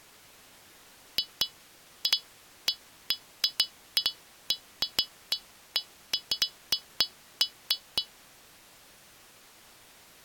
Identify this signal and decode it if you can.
Irregular taps on glass. There is no code.